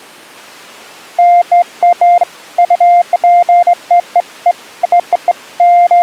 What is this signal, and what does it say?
Beeps of irregular length. There is no code.